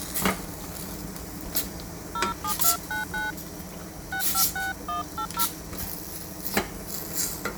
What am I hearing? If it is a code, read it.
DTMF, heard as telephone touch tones, dialled by hand, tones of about 130 ms, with kitchen noise. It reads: 07299 656180